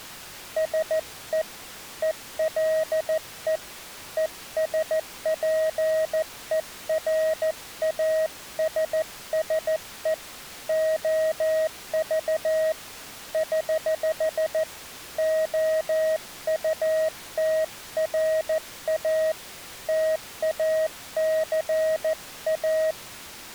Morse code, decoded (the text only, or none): SE ELE ESPERASSE OV <HH> OUTRA TACA